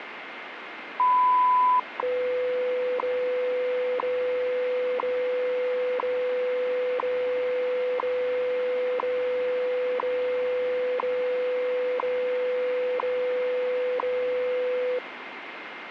Radio time signal (WWV, Colorado), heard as ticks, one a second, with radio static.